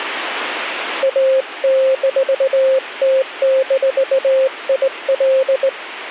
Morse code, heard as a keyed tone, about 19 wpm, 530 Hz. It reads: A-T-IL